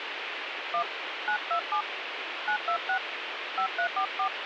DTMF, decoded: 1 927 926 5344

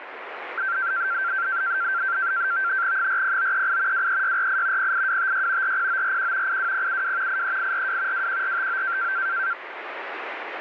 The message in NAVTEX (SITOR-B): 40938 23648 08256 40941 82072 83842 21459

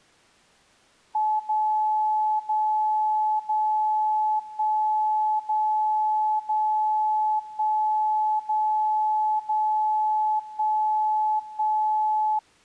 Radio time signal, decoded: 0 0 0 1 0 0 1 0 0 1 1

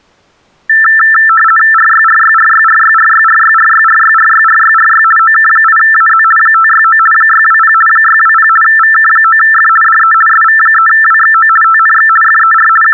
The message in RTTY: RYRYRYRYRYRYRYRYRYRYRY OK8AZ 569 620 620 VK9F DE SV3WXO TNX FER …

